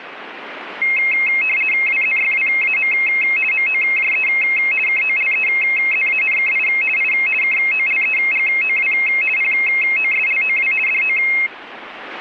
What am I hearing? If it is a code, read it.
RTTY (50 baud, 450 Hz shift), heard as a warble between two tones, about 2350 Hz centre. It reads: WZYWAM MOJE KOLEZANKI I KOLEGOW POSLOW DO